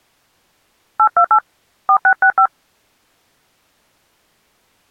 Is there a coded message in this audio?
Yes: DTMF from 1.0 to 2.5 s, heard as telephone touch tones, dialled by hand, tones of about 80 ms. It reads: 828 4665